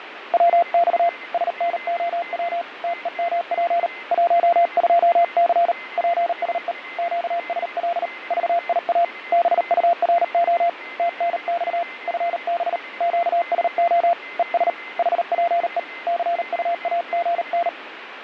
Morse code, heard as a keyed tone, hand-sent with a paddle, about 38 wpm, 690 Hz, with radio static, fading and a weaker station near 2060 Hz. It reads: WX SNOW TEMP 12C PSE QSL VIA BURO TNX FB QSO ES HPE CUAGN